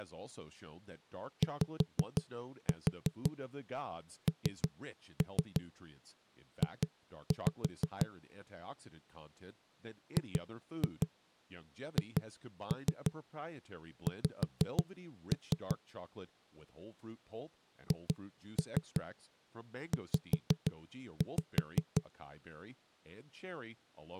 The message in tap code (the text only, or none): YNJ GHX HZ